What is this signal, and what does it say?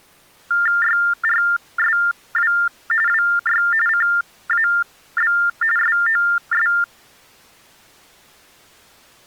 TTY/TDD text telephone tones (45.45 baud Baudot), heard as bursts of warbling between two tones, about 400 Hz shift, 1600 Hz centre. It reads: YRSW WY CAB SOS